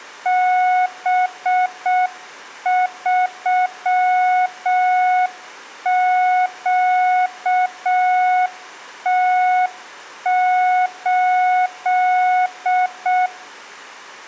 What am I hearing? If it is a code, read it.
Morse code, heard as a keyed tone, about 6 wpm, 730 Hz, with room echo. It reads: B3QT8